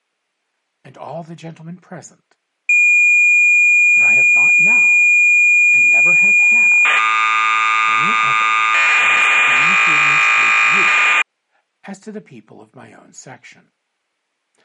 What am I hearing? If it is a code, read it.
Cassette data (Kansas City type), 1200 baud, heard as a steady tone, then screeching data.